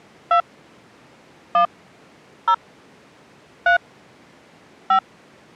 DTMF, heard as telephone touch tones, dialled by hand, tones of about 90 ms. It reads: 2 1 0 3 5